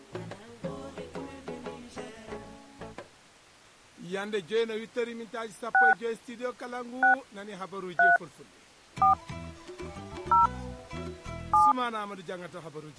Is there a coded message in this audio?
Yes: DTMF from 5.7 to 11.7 s, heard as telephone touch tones, dialled by hand, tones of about 160 ms. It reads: 6 6 3 4 0 7